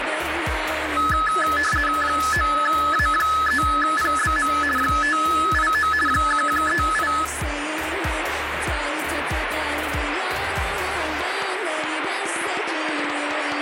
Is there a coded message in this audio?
Yes: RTTY (50 baud, 450 Hz shift) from 1.0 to 7.2 s, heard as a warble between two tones, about 1500 Hz centre, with radio static. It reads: 9A3PBM 589 1138